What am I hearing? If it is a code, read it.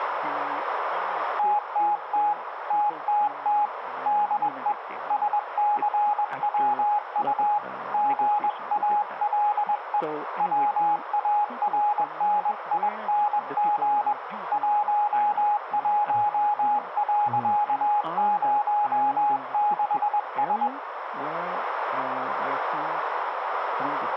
Morse code, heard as a keyed tone, hand-sent with a paddle, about 21 wpm, 830 Hz, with radio static and a narrow filter. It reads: TTT TTT DE SCWU GALE WARNING 11.06S